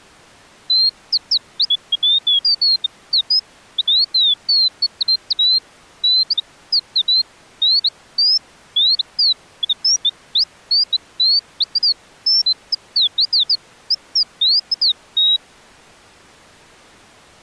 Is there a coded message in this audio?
No, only bird-like chirps.